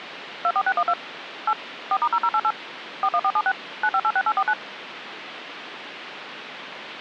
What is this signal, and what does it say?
DTMF, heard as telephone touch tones, dialled by machine, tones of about 60 ms, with phone line noise. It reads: 24612 8 4*0088 41476 9586849